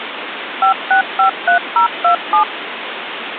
DTMF, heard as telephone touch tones, dialled by machine, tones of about 110 ms, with phone line noise. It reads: 5653027